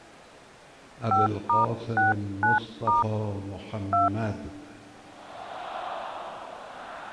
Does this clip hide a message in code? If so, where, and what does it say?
Yes: DTMF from 1.1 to 4.1 s, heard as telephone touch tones, dialled by hand, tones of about 150 ms. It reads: 5*69* 2